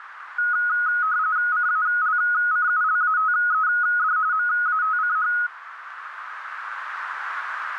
RTTY (45.45 baud, 170 Hz shift), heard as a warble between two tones, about 1360 Hz centre, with radio static and a narrow filter. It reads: CALCULATED MATCH